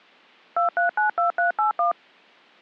DTMF, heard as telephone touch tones, dialled by machine, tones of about 120 ms. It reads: 2392381